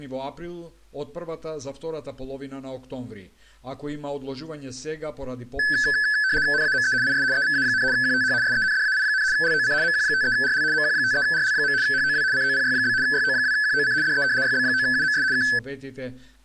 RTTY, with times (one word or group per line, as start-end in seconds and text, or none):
6.5-6.9 NAME
7.0-7.2 IS
7.3-7.8 EVA,
7.9-8.3 QTH
8.4-9.2 SENDAI,
9.3-9.7 LOC
9.8-10.6 MQ53RL
10.7-11.7 MQ53RL.
11.8-12.2 HOW
12.3-12.9 COPY?
13.0-13.9 YO2QOC
14.0-14.2 DE
14.4-15.2 YB9UMS
15.3-15.4 K